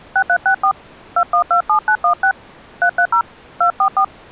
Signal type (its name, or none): DTMF